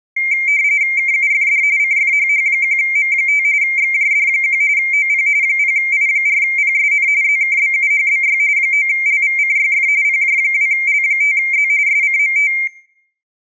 RTTY (45.45 baud, 170 Hz shift), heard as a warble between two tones, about 2200 Hz centre, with room echo. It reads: KUFD CFHH1M5 XJD1 OP 0I4PSN ZKBUHBY 9LVCYF PJ2L5Z SCMT